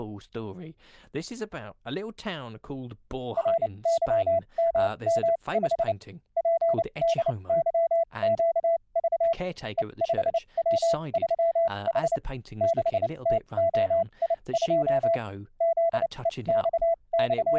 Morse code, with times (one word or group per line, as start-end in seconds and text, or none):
3.4-5.9 RYMM5
6.4-9.3 PDYQV
9.8-12.2 E5W3H
12.6-15.2 6TOI2
15.6-17.6 …